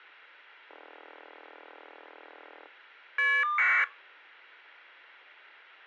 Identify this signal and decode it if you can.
Caller ID data burst, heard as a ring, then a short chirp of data, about 1200 baud.